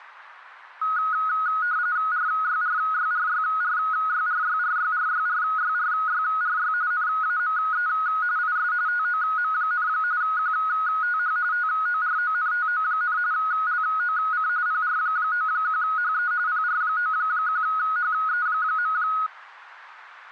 RTTY (45.45 baud, 170 Hz shift), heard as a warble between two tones, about 1360 Hz centre. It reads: RYRYRYRYRYRYRYRYRYRY NAME IS TOM, QTH TORONTO, LOC PR91HE PR91HE.